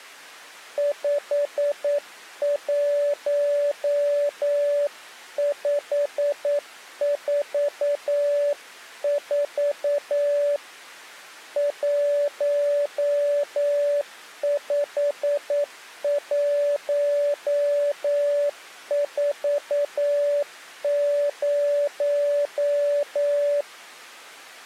Morse code, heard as a keyed tone, hand-sent with a paddle, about 9 wpm, 580 Hz. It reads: 51544 15140